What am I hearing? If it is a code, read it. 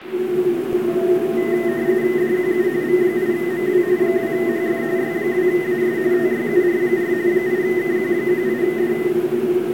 RTTY (45.45 baud, 170 Hz shift), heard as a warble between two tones, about 1950 Hz centre, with radio static and the noise inside a subway train. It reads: DQU V8MW 2HF Y2AS TYUR4 8KQ18D